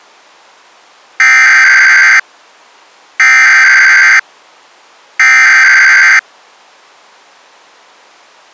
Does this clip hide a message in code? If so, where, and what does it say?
Yes: Emergency Alert System (SAME) tones (header bursts) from 1.2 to 6.2 s, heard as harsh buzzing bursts, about 520.83 baud.